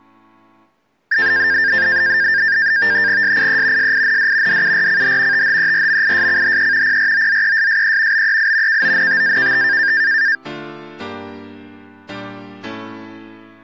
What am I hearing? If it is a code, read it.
NAVTEX (SITOR-B), 100 baud, 170 Hz shift, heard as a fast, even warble, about 1700 Hz centre. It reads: SIE SIND DURCH THERMISCHE PROZESSE BEI KONTAKT